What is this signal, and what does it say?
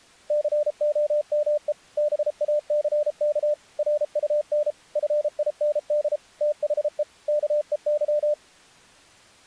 Morse code, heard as a keyed tone, machine-sent, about 33 wpm, 600 Hz. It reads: COME BACK RUN FIND THE KEY